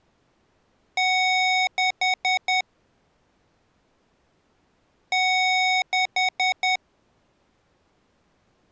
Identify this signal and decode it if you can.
Beep code, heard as beeps from a small speaker, played twice, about 740 Hz. 1 long, 4 short.